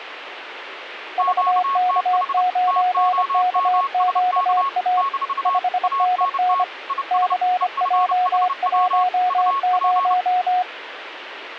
Morse code, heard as two keyed tones, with radio static. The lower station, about 25 wpm, 730 Hz: VK9KQA 5NN CJ10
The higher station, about 30 wpm, 1100 Hz: QTH TOMSK - ANT IS EFHW UP